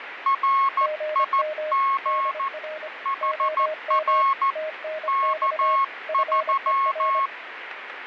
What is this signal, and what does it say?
Morse code, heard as two keyed tones, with radio static. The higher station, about 14 wpm, 1090 Hz: RIG HR K3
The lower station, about 25 wpm, 620 Hz: GM DR OM TNX FER